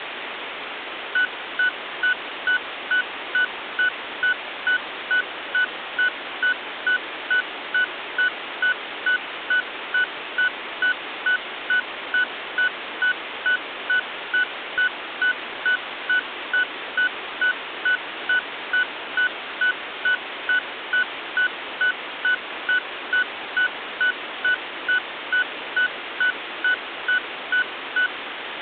Evenly repeated beeps, with phone line noise. There is no code.